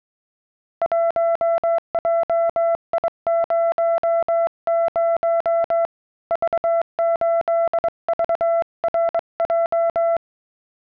Morse code, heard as a keyed tone, hand-sent with a straight key, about 22 wpm, 670 Hz. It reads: 1JI00 V8VRJ